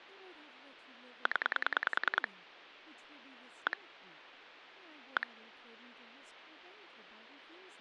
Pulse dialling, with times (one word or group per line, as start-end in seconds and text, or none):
1.3-2.3 0
3.7-3.8 1
5.2-5.3 1